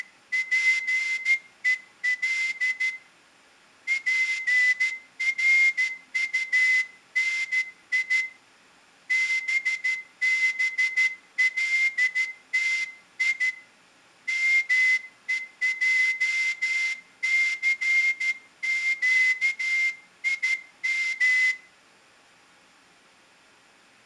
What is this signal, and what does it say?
Morse code (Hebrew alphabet), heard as a whistle, hand-sent with a straight key, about 13 wpm, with room echo. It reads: … פרטני בבלתי מועסקים